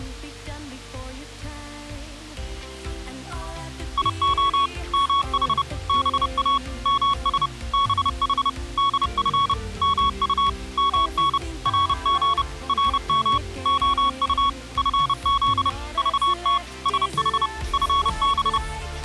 Morse code, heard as a keyed tone, machine-sent, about 30 wpm, 1110 Hz. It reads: IO MH BA MS BH DF MU MN RG RM OU FZ VT SH FB